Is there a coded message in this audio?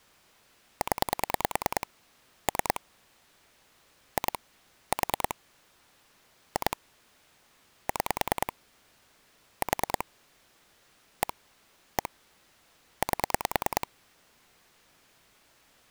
Yes: pulse dialling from 0.8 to 13.8 s, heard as clicks on a phone line, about 9 pulses a second. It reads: 0 3 2 4 2 6 4 1 1 8